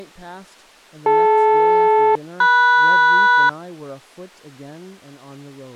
Aircraft SELCAL, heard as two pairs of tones, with speech in English. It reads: DL-MS